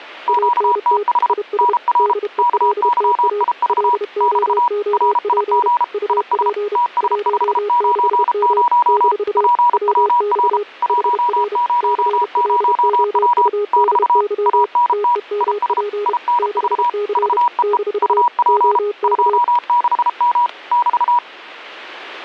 Morse code, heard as two keyed tones, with static crashes. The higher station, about 33 wpm, 960 Hz: QTH NR KYIV <BT> RIG IS TS590 PWR 100W <BT> ANT IS INV VEE UP 26M <BT>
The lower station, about 31 wpm, 410 Hz: ANT IS DELTA LOOP UP 16M - WX HR CLOUDY TEMP 6C - OK